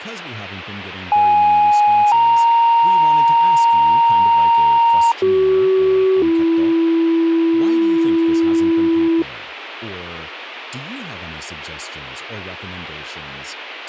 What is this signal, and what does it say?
Two-tone page, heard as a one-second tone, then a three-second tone, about 830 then 930 Hz, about 380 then 330 Hz, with a squelch burst at the end and speech in English.